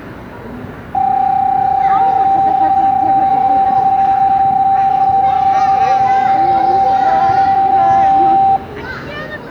PSK31 (31.25 baud), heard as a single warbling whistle, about 780 Hz, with room echo and the noise of a residential street.